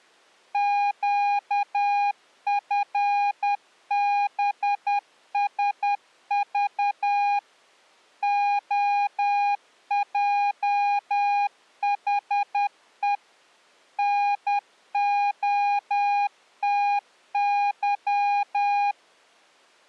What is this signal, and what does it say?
Morse code, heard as a keyed tone, machine-sent, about 10 wpm, 810 Hz. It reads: QFBSV OJHE NOTY